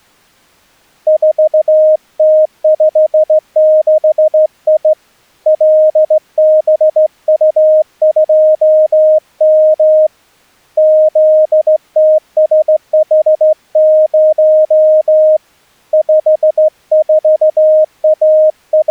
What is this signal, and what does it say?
Morse code, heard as a keyed tone, hand-sent with a straight key, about 15 wpm, 620 Hz. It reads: 4T56I LBU2M ZTSH0 …